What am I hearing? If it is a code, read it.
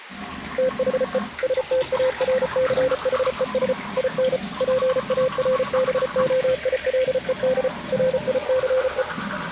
Morse code, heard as a keyed tone, machine-sent, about 34 wpm, 520 Hz, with the noise of a restroom. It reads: THE STARCHES IN PARBOILED RICE